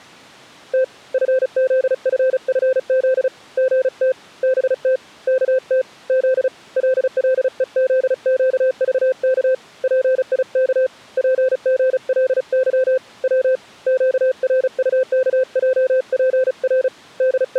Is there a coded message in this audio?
Yes: Morse code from 0.7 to 17.6 s, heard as a keyed tone, hand-sent with a paddle, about 35 wpm, 520 Hz. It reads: T FZFFZ GT BT KT Z LLEZQVK PIK PGLY W QRUKJPR …